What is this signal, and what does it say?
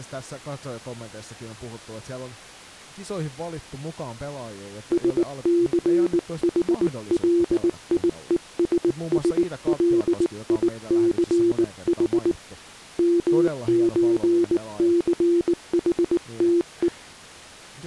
Morse code (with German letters), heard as a keyed tone, hand-sent with a paddle, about 19 wpm, 340 Hz, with speech in Finnish. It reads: SCHLIESSLICH MÖCHTE